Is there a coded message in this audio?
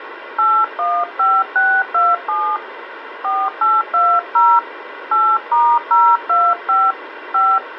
Yes: DTMF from 0.4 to 7.6 s, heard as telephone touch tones, dialled by hand, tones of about 240 ms, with phone line noise. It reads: 815627 4820 8*025 5